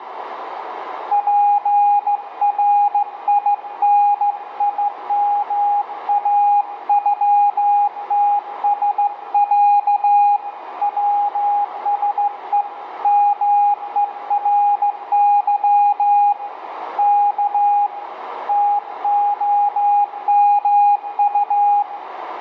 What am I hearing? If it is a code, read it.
Morse code (Russian alphabet), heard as a keyed tone, hand-sent with a straight key, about 15 wpm, 820 Hz, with radio static, a narrow filter and room echo. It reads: ПРИНИМАЮТСЯ ВСЕ МЕРЫ К ТОМУ